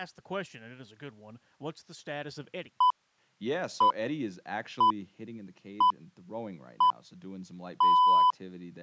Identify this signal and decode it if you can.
Radio time signal (six pips, as the Greenwich Time Signal), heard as pips, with speech in English.